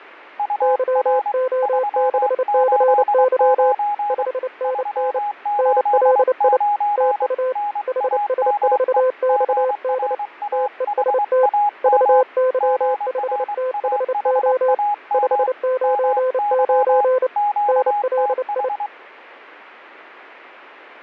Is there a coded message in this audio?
Yes: Morse code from 0.3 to 18.9 s, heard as two keyed tones. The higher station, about 23 wpm, 830 Hz: UR 389 389 NAME GRAHAM GRAHAM MY QTH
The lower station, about 29 wpm, 510 Hz: YO6CY 5NN NLI TU HS4XD TEST VY5THO 599 NLI